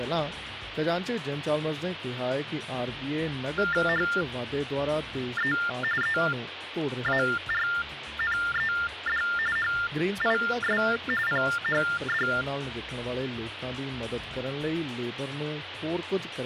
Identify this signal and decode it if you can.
TTY/TDD text telephone tones (45.45 baud Baudot), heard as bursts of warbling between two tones, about 400 Hz shift, 1600 Hz centre, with phone line noise. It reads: HE EARNED HIS PHD